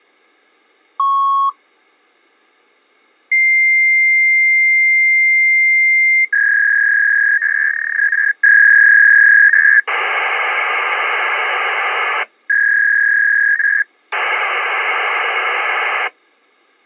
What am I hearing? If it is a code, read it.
Fax machine handshake, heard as a beep, a long tone, a warble and hiss.